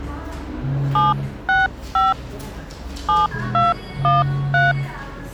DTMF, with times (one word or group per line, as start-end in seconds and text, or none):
1.0-2.1 765
3.1-4.7 7213